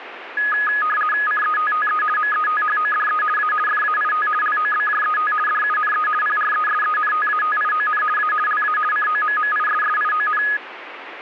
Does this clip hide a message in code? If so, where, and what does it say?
Yes: RTTY (50 baud, 450 Hz shift) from 0.4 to 10.6 s, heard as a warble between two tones, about 1470 Hz centre, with radio static. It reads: CETTE METHODE A FAIT LOBJET DUNE PRESENTATION A LA COMMISSION